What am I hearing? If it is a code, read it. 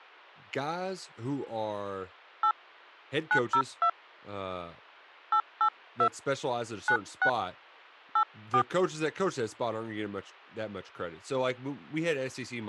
DTMF, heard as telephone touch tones, dialled by hand, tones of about 80 ms, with speech in English. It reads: 8 902 882 96 84